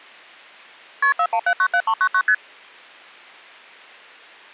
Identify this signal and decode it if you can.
Multi-frequency trunk signalling (R1, as on North American trunks), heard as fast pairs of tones, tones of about 70 ms. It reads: KP 41797399 ST